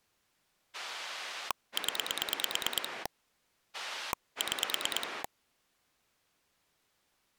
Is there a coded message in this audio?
Yes: pulse dialling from 0.7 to 5.3 s, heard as a rotary dial, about 9 pulses a second. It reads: 0 6